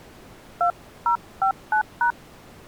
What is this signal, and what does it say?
DTMF, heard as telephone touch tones, dialled by hand, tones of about 100 ms. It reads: 2059#